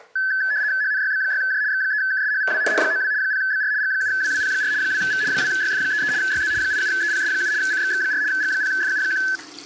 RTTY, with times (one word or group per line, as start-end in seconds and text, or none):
0.8-1.6 HNYB6J
1.7-2.6 X3KSHVW
2.7-3.1 H92
3.2-3.7 0BR
3.8-4.7 G7WWP4
4.8-5.2 2V
5.3-6.1 2YF33
6.2-6.5 YZ
6.6-7.5 87EPS7
7.6-8.2 CXX4
8.3-9.2 G0FU1